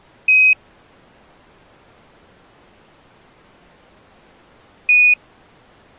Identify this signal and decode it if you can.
Quindar tones, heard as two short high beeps.